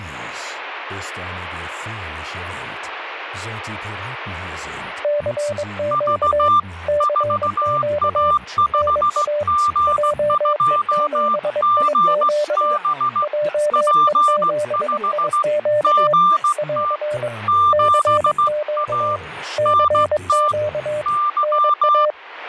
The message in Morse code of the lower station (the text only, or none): CQ CQ NA JE7IQ JE7IQ <AR> CQ CQ NA